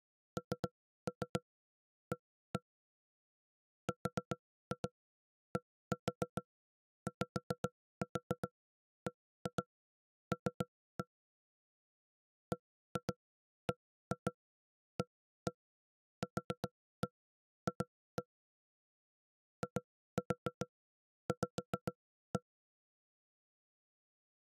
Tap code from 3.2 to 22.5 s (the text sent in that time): RDYBL BBAQF IV